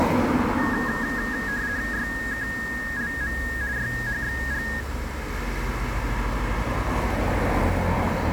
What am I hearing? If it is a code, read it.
RTTY (50 baud, 170 Hz shift), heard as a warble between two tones, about 1750 Hz centre, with radio static, a narrow filter and street noise. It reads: YKLM YHXG